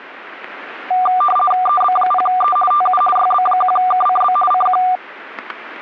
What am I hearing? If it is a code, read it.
RTTY (50 baud, 450 Hz shift), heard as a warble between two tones, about 960 Hz centre, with static crashes. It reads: EB0E TU YB1KCB CQ